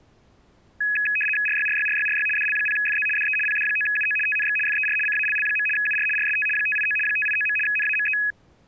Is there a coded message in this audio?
Yes: RTTY (75 baud, 850 Hz shift) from 0.8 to 8.3 s, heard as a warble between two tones, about 2100 Hz centre. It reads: RYRYRYRY DL0FZ DE PD9UO TNX FER CALL. UR RST 589 589. NAME